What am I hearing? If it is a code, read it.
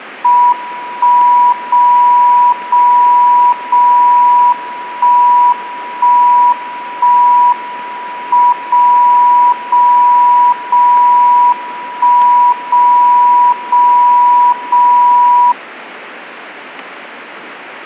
Radio time signal (WWVB), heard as a tone whose level steps once a second, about 980 Hz. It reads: 1 0 0 0 1 1 1 M 0 0 0 1 0 0 0